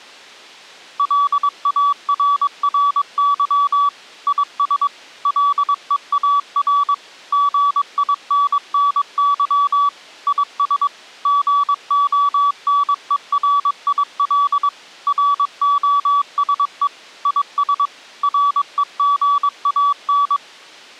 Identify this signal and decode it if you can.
Morse code, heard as a keyed tone, machine-sent, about 22 wpm, 1140 Hz. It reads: LARRY IS LEAR GINNY IS GONERIL ROSE IS REGAN